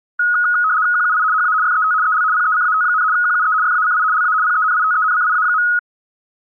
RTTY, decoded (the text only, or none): QUI HA FET EL PECAT, QUE FACI LA PENITENCIA.